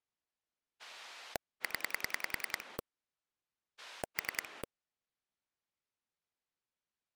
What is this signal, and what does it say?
Pulse dialling, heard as a rotary dial, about 10 pulses a second. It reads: 0 3